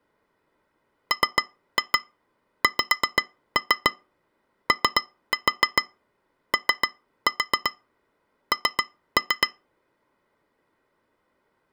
Tap code, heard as taps on glass, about 7 knocks a second. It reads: MXOON